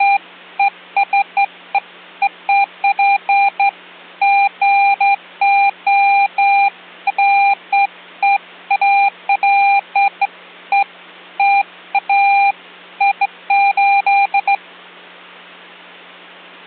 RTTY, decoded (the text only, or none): none